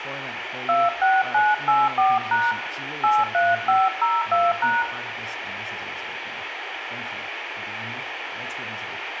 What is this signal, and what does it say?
DTMF, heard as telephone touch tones, dialled by hand, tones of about 200 ms, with radio hiss, a squelch burst at the end and room echo. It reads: 26984# 83502#